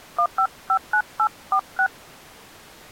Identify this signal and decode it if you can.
DTMF, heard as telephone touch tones, dialled by hand, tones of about 80 ms. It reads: 1559846